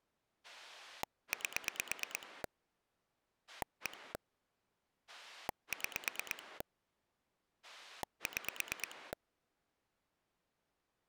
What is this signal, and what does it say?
Pulse dialling, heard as a rotary dial, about 8 pulses a second. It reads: 8 1 6 6